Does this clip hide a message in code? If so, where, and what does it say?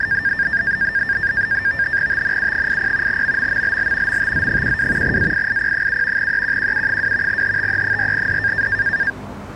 Yes: NAVTEX (SITOR-B), 100 baud, 170 Hz shift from 0.0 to 9.1 s, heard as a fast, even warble, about 1700 Hz centre, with street noise. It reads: TNU80 MMMLL MTZ12 AIIP7 EQQU2 HTE4D